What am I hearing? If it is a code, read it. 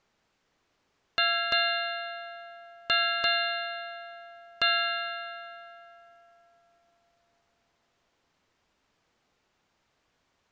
Ship's bell, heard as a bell. 5. Five half-hours of the watch have passed.